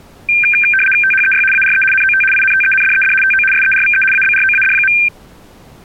RTTY (75 baud, 850 Hz shift), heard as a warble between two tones, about 2000 Hz centre. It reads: THEY ARE NOT INTENDED TO SERVE ABROAD.